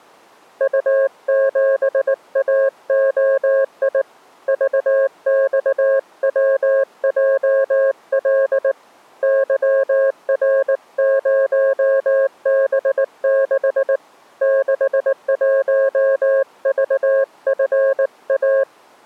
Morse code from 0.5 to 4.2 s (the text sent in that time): U7AOI